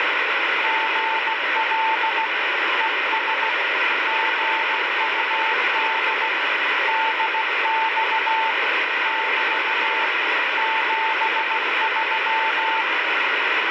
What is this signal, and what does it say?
Morse code, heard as a keyed tone, hand-sent with a paddle, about 16 wpm, 890 Hz, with heavy radio static. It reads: GL ES GUD DX <BT> 73